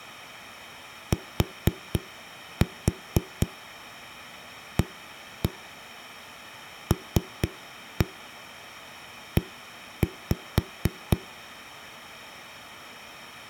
Tap code, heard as knocks on a wall, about 4 knocks a second. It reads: TALE